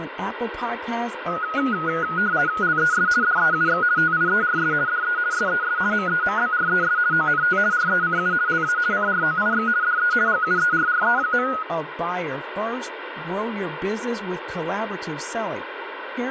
RTTY (50 baud, 170 Hz shift), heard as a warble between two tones, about 1360 Hz centre, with radio static, room echo and speech in English. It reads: LES DEUX TIERS DE SES MEMBRES ONT RECU LA CROIX DE GUERRE.